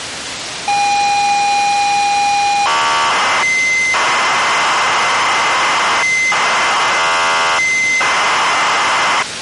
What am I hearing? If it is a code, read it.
ZX Spectrum tape loading, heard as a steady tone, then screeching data, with tape hiss.